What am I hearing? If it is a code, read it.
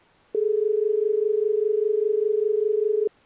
Telephone call progress tone (as in Australia), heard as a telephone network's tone, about 430 Hz. Dial tone.